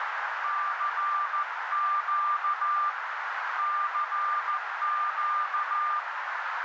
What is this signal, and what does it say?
Morse code, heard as a keyed tone, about 14 wpm, 1190 Hz, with heavy radio static and a narrow filter. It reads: CQ CQ